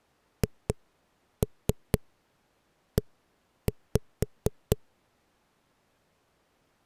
Tap code, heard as knocks on a wall, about 4 knocks a second. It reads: HE